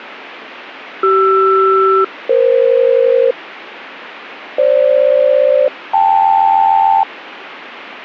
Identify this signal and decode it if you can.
Aircraft SELCAL, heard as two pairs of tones. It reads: CR-EF FG-KL